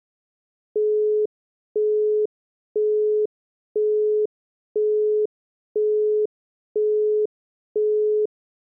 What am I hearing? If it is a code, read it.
Telephone call progress tone (single-tone plan, as in Europe, Japan and elsewhere), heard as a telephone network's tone, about 420 Hz, 0.5 s on and 0.5 s off. Busy tone.